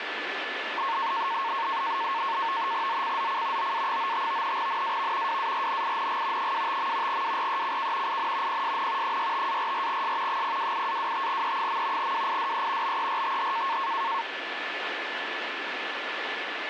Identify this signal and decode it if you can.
NAVTEX (SITOR-B), 100 baud, 170 Hz shift, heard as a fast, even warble, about 1000 Hz centre, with radio static and a steady whistle near 1740 Hz. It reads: ZCZC OA95 NAV WARNING 25. WRECK IN PSN 65-44S 028-25E. WIDE BERTH